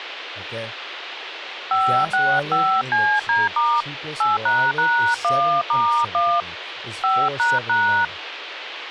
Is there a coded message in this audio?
Yes: DTMF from 1.7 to 8.0 s, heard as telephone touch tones, dialled by hand, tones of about 270 ms, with radio hiss, a squelch burst at the end and speech in English. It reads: 565CD* 8##1*1 5##